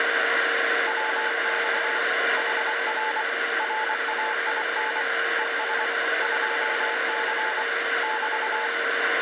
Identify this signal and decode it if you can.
Morse code, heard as a keyed tone, hand-sent with a paddle, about 24 wpm, 870 Hz, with radio static and a steady whistle near 460 Hz. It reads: WX HR RAIN ES 2C <BT>